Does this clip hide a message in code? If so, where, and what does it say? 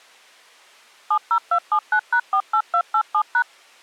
Yes: DTMF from 1.1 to 3.4 s, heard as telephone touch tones, dialled by machine, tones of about 80 ms. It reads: 70279#48287#